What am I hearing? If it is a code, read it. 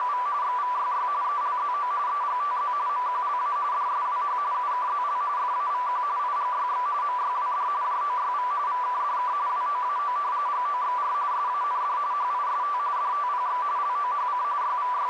RTTY (45.45 baud, 170 Hz shift), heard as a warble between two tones, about 1080 Hz centre, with radio static and a narrow filter. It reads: … XVYY ELZO EGTZ MQLA DSWH UKZL FAVQ IGYX MYWD JOYV VKDK WOAO GOXR SAND HIST DTPX LOHC …